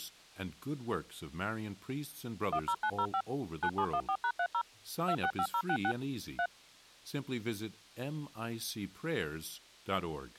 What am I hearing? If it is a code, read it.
DTMF, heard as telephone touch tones, dialled by machine, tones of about 70 ms, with speech in English. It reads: 10905 9714#30 265066 3